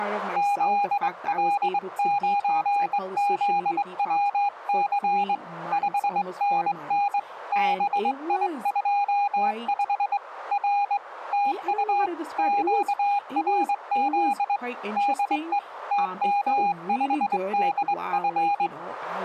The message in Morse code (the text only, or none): ZL9ZWC 5NN BI25 R TU QRZ DE TM5DF